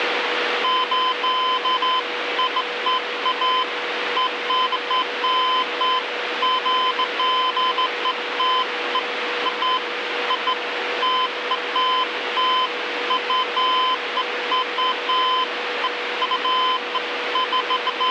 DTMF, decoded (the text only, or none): none